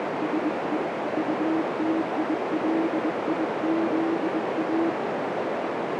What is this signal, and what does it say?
Morse code, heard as a keyed tone, hand-sent with a bug key, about 21 wpm, 320 Hz, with heavy radio static and a narrow filter. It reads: SE UTILIZA